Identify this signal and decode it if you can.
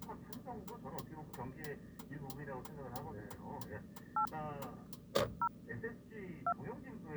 DTMF, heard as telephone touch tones, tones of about 80 ms, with the noise inside a car. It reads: 8 0 2